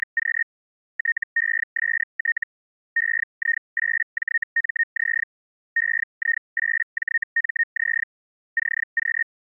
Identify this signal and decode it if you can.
Hellschreiber (Feld-Hell, 122.5 baud), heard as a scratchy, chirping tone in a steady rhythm, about 1850 Hz. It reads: … TEST EI8JMZ EI8JMZ CQ